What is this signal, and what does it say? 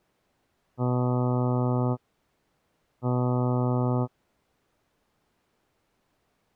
Ship horn signal, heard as a ship's horn, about 120 Hz. 2 short. At sea: I am altering course to port.